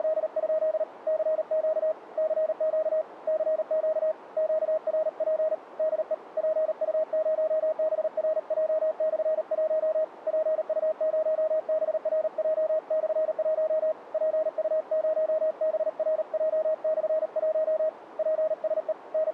Morse code, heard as a keyed tone, hand-sent with a paddle, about 38 wpm, 630 Hz, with radio static. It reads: … CQ CQ CQ QRP DE PU0BRJ/1 PU0BRJ/1 PU0BRJ/1 PSE …